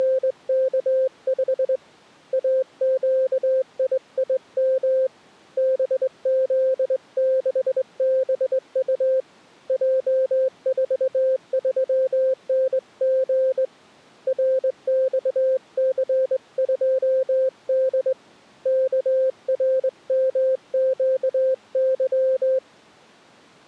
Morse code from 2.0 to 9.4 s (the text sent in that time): AQIIM BZ6BU